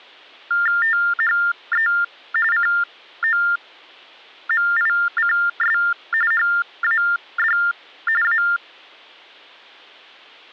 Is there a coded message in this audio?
Yes: TTY/TDD text telephone tones (45.45 baud Baudot) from 0.5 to 8.6 s, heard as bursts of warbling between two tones, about 400 Hz shift, 1600 Hz centre. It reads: THE COMICS HAD A